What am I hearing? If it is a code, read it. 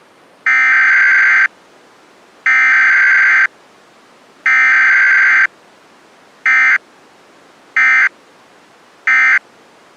Emergency Alert System (SAME) tones (header bursts, then end-of-message bursts), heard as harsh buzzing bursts, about 520.83 baud.